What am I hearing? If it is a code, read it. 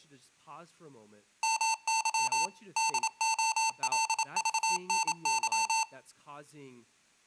Morse code (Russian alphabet), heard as electronic beeps, machine-sent, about 27 wpm, 890 Hz, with speech in English. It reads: МЫ ДОЛЖНЫ